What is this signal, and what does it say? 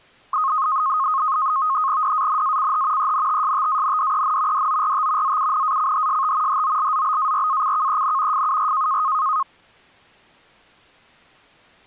NAVTEX (SITOR-B), 100 baud, 170 Hz shift, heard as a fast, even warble, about 1160 Hz centre. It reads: DANACH ENTSTANDEN DORT ZUNACHST HOLZBARACKEN FUR